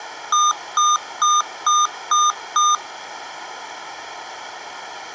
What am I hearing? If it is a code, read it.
Beep code, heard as beeps from a small speaker, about 1210 Hz, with room echo. 6 short. In AMI BIOS tables: keyboard controller gate A20 failure; in Dell tables: video card failure.